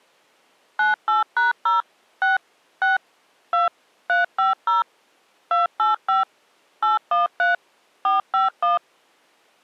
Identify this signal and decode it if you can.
DTMF, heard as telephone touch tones, dialled by machine, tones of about 150 ms. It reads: 98#0 6 6 2 350 285 813 451